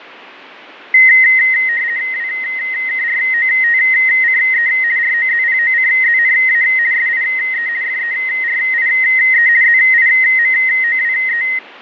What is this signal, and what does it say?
RTTY (50 baud, 170 Hz shift), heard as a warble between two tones, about 1950 Hz centre, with radio static and fading. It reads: WKROTCE ROZPOCZNA SIE FERIE ZIMOWE